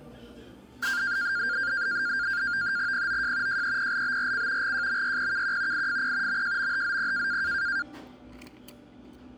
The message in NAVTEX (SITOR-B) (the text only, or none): POJ JEPLBRC GJMYPKQ IFP MJMHZP